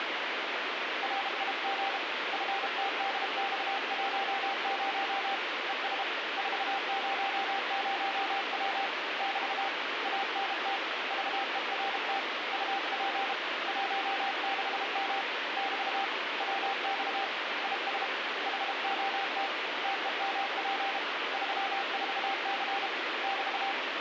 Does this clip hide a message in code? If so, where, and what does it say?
Yes: Morse code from 1.0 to 23.8 s, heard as a keyed tone, hand-sent with a paddle, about 32 wpm, 790 Hz, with heavy radio static. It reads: RIG FTDX10 ES 400W <BT> ANT VERT UP 16M <BT> WX IS HOT TEMP 34C <BT>